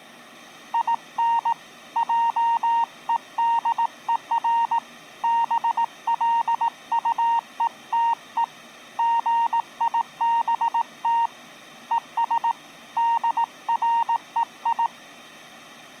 Morse code, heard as a keyed tone, hand-sent with a paddle, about 18 wpm, 930 Hz. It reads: IN JEDER BLUETE GIBT ES DREI